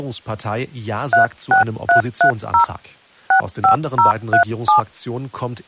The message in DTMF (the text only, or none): 36330 65037